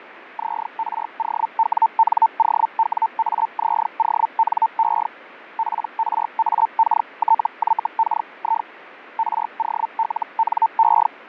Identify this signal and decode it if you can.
Hellschreiber (Feld-Hell, 122.5 baud), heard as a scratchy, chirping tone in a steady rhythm, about 900 Hz, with radio static and fading. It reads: ZROWNOWAZONE PRAKTYKI ROLNE